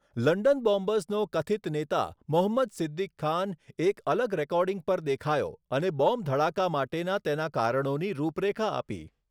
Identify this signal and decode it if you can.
Speech in Gujarati. There is no code.